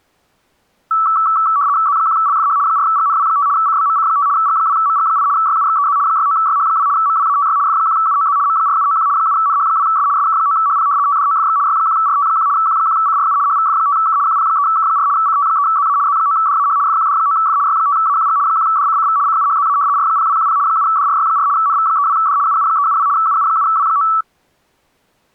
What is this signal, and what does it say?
RTTY (75 baud, 170 Hz shift), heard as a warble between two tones, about 1230 Hz centre. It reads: Z1LFH 4GNW5 CBMC5 G2MG8 YUXEZ 69YH2 MWATY F1UOZ M4791 7NH2S SK9HP TDOFX Y1RT1 Q1CRU HVF5K QP3K4 CT3ZA Z9DAH FQD9F Y5AQG 1DCCV CUHZA R0210 7DRY4 NV32D UU372 UU7W9